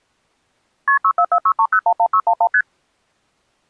Multi-frequency trunk signalling (R1, as on North American trunks), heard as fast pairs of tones, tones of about 70 ms. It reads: KP 64463011611 ST